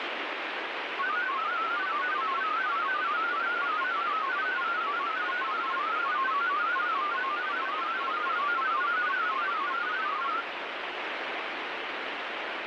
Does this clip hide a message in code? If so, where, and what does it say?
Yes: multi-tone FSK (Olivia or MFSK type), about 500 Hz wide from 1.0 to 10.5 s, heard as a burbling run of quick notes, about 31.25 baud, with radio static.